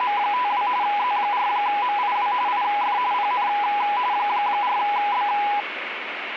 RTTY (45.45 baud, 170 Hz shift), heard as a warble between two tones, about 910 Hz centre, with radio static. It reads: … Z4MIW IF PN 4B